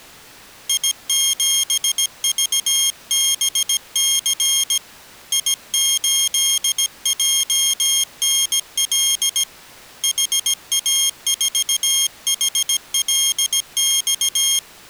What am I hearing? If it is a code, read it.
Morse code, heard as a high beeper, hand-sent with a paddle, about 17 wpm, 3250 Hz. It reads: I7VBC I8JNL HA4HLX